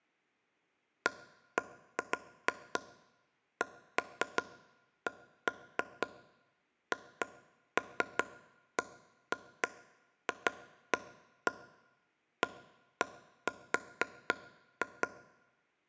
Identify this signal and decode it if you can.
Irregular taps on a table. There is no code.